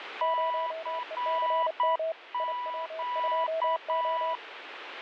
Morse code, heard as two keyed tones, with radio static. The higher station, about 8 wpm, 980 Hz: CQ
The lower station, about 30 wpm, 650 Hz: 0ECM IW2O